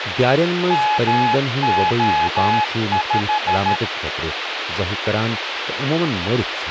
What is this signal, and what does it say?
Morse code, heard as a keyed tone, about 13 wpm, 850 Hz, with radio hiss and speech in Kashmiri. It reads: MO5